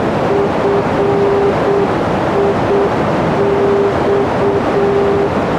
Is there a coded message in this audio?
Yes: Morse code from 0.2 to 5.3 s, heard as a keyed tone, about 7 wpm, 400 Hz, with heavy radio static and a narrow filter. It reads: FIX